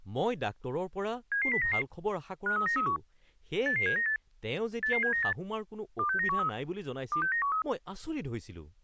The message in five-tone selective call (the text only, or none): 77099 53931 88798 88798 26913 26913